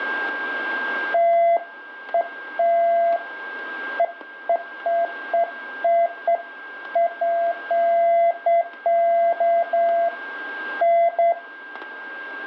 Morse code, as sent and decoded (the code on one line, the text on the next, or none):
none